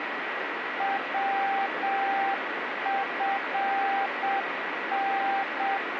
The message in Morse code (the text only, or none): WFN